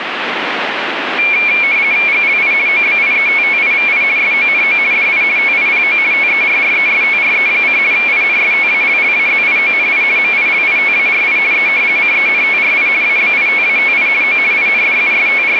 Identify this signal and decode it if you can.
RTTY (50 baud, 170 Hz shift), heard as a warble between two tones, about 2300 Hz centre, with radio static. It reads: GLI OBIETTIVI SONO DI TIPO TERRESTRE: INSTALLAZIONI MILITARI E CENTRI ABITATI O …